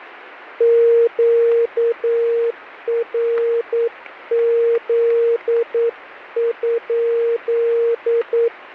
Morse code, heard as a keyed tone, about 9 wpm, 470 Hz, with radio static. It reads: QRZ?